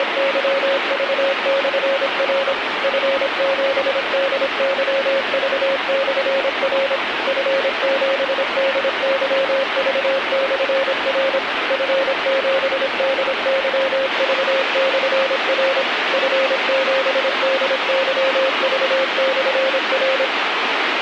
Morse code, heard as a keyed tone, machine-sent, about 26 wpm, 540 Hz, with radio static. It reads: … F7DYV/R F7DYV/R F7DYV/R F7DYV/R